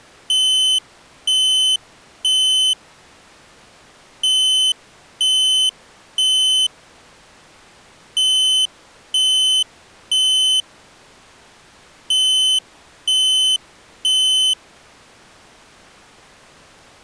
Alarm pattern, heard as an alarm's beeps, played four times, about 3050 Hz. Temporal three. Smoke or fire, evacuate.